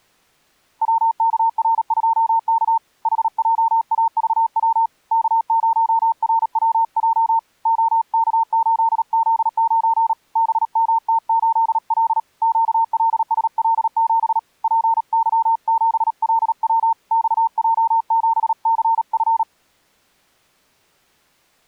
Morse code, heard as a keyed tone, hand-sent with a paddle, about 37 wpm, 910 Hz. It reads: WKR2K HJAVW K0RWJ OK8Z9 BMT8L QLSL7 PY7LW XJ7CF